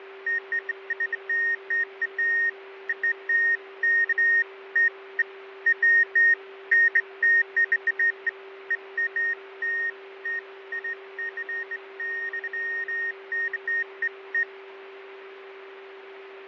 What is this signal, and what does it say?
Beeps of irregular length, with radio static, fading and a steady whistle near 390 Hz. There is no code.